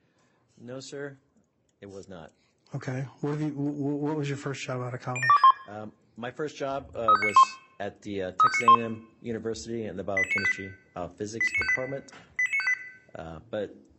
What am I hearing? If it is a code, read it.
Five-tone selective call (ZVEI), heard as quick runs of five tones, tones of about 70 ms, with room echo. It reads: 07261 35991 35991 88958 88958 88958